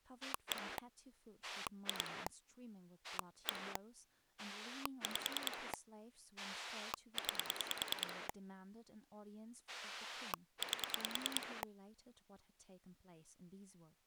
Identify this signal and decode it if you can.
Pulse dialling, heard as a rotary dial, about 10 pulses a second, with speech in English. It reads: 1 2 1 5 9 8